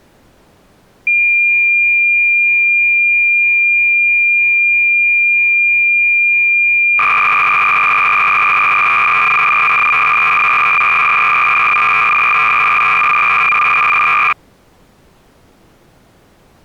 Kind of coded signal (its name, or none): cassette data (Kansas City type)